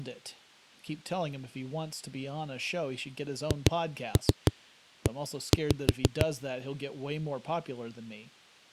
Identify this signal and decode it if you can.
Tap code, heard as knocks on a wall, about 6 knocks a second, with speech in English. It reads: HE